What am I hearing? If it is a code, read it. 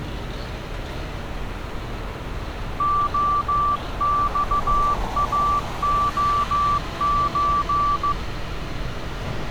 Morse code (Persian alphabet), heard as a keyed tone, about 15 wpm, 1160 Hz, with street noise. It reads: عخاعچ